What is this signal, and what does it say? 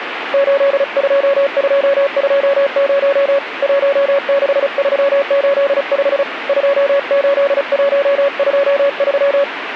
Morse code, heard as a keyed tone, hand-sent with a paddle, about 35 wpm, 560 Hz, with radio static. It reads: 82220 16385 28123